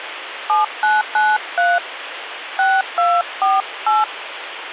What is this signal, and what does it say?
DTMF, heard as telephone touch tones, dialled by hand, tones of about 200 ms, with phone line noise. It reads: 7993 6248